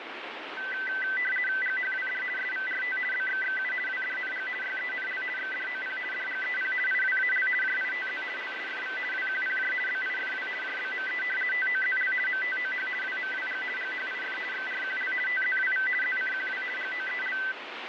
RTTY (50 baud, 450 Hz shift), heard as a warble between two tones, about 1750 Hz centre, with radio static. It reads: GHWD SVRT BXXU WDNG YENL XDOP DGEP IWAL JITZ LSFV WQPJ BIFW JBME TOZL MTOH WMWG GHIF XRQL TZWV ZCQW GOEL